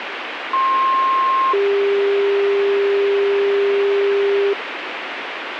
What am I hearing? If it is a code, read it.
Two-tone page, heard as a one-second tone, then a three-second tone, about 1060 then 400 Hz, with radio hiss.